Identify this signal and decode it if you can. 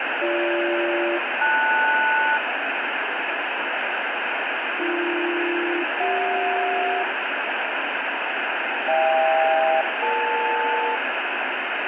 Aircraft SELCAL, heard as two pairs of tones, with heavy radio static. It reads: BG-LS AB-CJ HK-EL